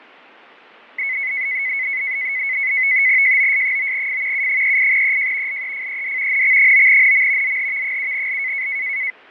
NAVTEX (SITOR-B), 100 baud, 170 Hz shift, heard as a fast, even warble, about 2100 Hz centre, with fading. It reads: JOS9F U38EJ LEFED NX9NM ZHV7L